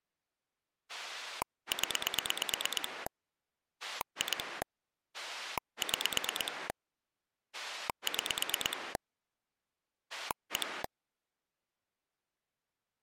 Pulse dialling, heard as a rotary dial, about 8 pulses a second. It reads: 0 2 6 6 1